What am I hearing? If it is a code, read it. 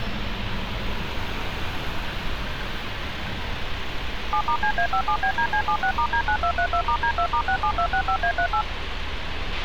DTMF, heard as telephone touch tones, dialled by machine, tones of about 80 ms, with radio hiss, a squelch burst at the end and street noise. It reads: 7*CA57BDC76*D9232*D2*67265A38